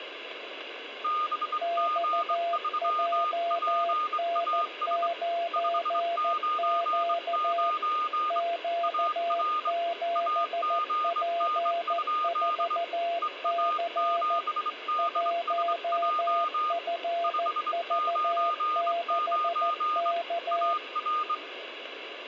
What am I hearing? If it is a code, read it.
Morse code, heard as two keyed tones, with radio static and room echo. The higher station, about 23 wpm, 1220 Hz: BG3PAS 599 AR AGN? EA7DSJ 599 AR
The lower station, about 14 wpm, 680 Hz: XJN9Q Q7P4C 1FV6K